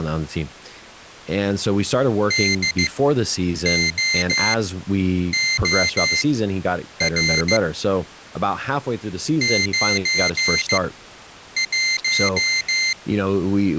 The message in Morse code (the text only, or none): DOOR 91